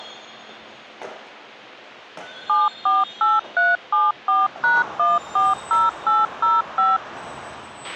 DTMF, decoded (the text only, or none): 748374#140805